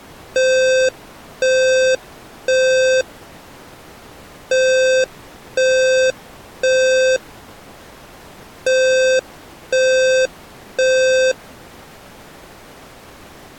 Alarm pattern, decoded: temporal three

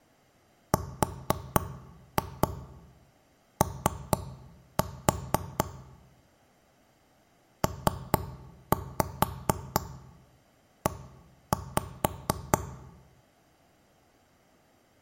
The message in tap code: RO PE

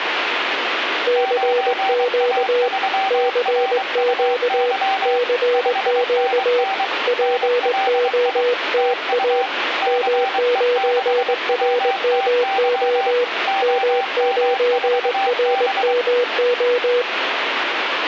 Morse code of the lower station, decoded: CQ CQ CQ POTA M9RMO M9RMO

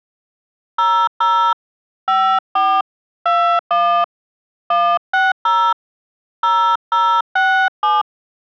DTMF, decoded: 00 54 21 160 0067

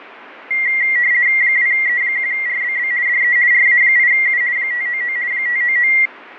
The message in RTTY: 2E1RBB DE RA8U 599 599

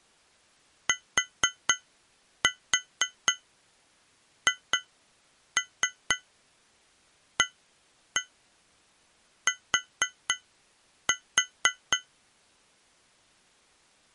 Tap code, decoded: THAT

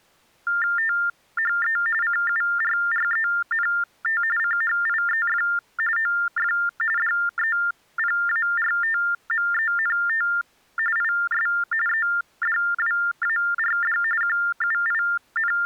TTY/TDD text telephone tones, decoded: THE CURRENT CHIEF OF DEPARTMENT IS EDWARD …

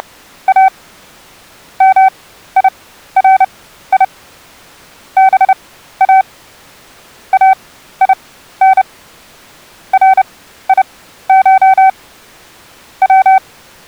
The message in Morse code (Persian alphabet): … میری با این ریش و

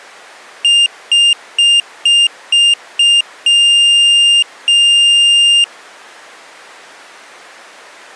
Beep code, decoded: 6 short, 2 long

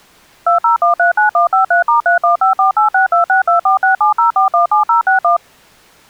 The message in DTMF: 20139153*3154862624670417061

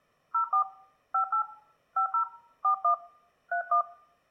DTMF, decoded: 04 58 50 41 31

